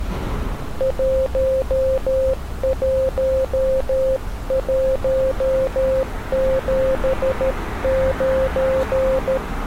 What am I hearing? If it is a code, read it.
Morse code, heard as a keyed tone, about 13 wpm, 530 Hz, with street noise. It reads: 11179